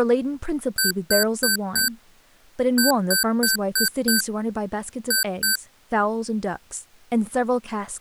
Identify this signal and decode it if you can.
Beep code, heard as beeps from a small speaker, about 1550 Hz, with speech in English. 4-5-2.